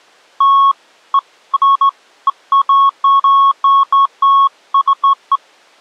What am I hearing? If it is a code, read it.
Beeps of irregular length. There is no code.